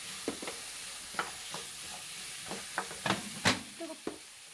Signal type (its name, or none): none